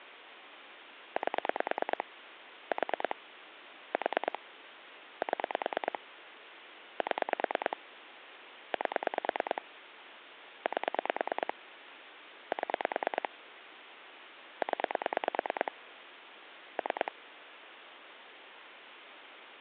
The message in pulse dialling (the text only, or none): 8 4 4 7 7 8 8 7 0 3